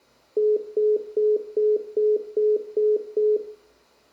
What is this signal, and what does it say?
Telephone call progress tone (single-tone plan, as in most of Europe), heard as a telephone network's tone, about 420 Hz, 0.2 s on and 0.2 s off, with room echo. Congestion tone.